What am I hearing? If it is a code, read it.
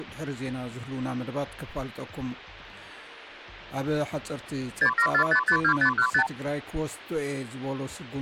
Multi-frequency trunk signalling (R2, with the far end's replies), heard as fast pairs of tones, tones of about 80 ms. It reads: 674552515